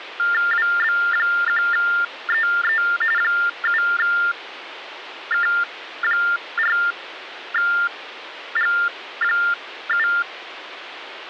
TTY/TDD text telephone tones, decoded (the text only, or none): WB1EE 7K4G7